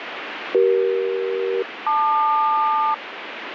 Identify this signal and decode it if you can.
Aircraft SELCAL, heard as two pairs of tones, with radio static. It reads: CE-LQ